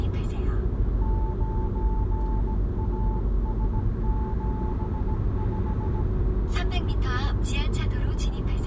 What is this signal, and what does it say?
Morse code, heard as a keyed tone, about 17 wpm, 870 Hz, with the noise inside a car. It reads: 9AS75